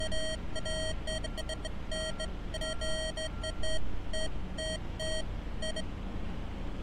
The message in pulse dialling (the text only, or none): none